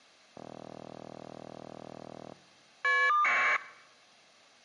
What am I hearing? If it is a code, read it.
Caller ID data burst, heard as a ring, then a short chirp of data, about 1200 baud.